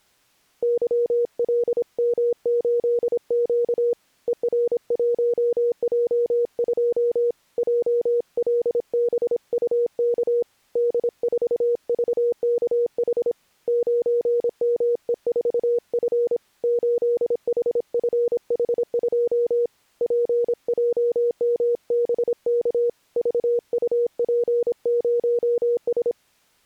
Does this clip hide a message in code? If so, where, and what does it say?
Yes: Morse code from 0.6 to 26.2 s, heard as a keyed tone, hand-sent with a paddle, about 26 wpm, 480 Hz. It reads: YLM8Q ER1J2 JLBUK D4VKH 9ME4F 8HFH2 PJMBK VUP0S